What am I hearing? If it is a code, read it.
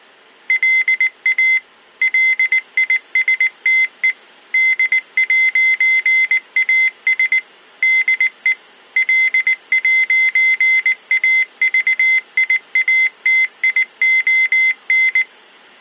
Morse code, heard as a high beeper, machine-sent, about 19 wpm, 2050 Hz. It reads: LA LISTE D'AS DE L'AVIATION